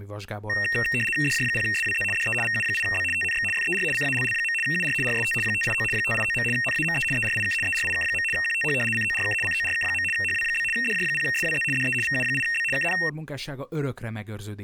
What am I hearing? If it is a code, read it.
RTTY (75 baud, 850 Hz shift), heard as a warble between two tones, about 2300 Hz centre, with speech in Hungarian. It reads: DJ0SWZ DE VU8B TNX FER CALL. UR RST 589 589. NAME ERIK ERIK. QTH CORK CORK. HW? DJ0SWZ DE VU8B KN